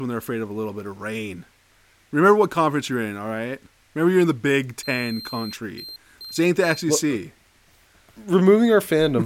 Beep code, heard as a piezo beeper, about 4150 Hz, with speech in English. 1 long, 3 short. In Award and IBM BIOS tables: video adapter failure; in AMI BIOS tables: memory failure.